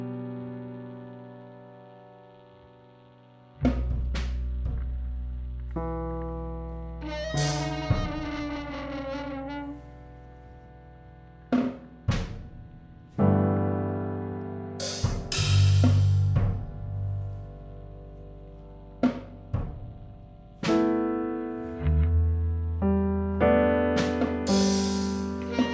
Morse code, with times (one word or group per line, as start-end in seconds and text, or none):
none